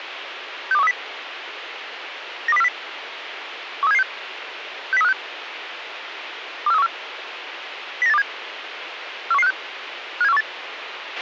Five-tone selective call (EEA), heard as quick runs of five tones, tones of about 40 ms, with radio hiss and a squelch burst at the end. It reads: 62130 92040 13776 60356 24314 09827 41156 57418